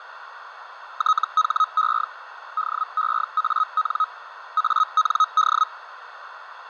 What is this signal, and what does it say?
Hellschreiber (Feld-Hell, 122.5 baud), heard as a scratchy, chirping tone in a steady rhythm, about 1270 Hz, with radio static, fading and a narrow filter. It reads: THE DEAN AND